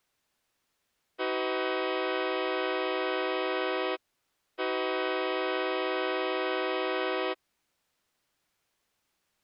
Train horn signal, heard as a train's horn. 2 long. On North American railways: brakes released, proceed.